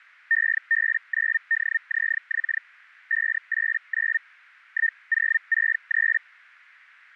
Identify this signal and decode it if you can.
Hellschreiber (Feld-Hell, 122.5 baud), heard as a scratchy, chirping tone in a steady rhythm, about 1800 Hz. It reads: EB9DZX 589 1063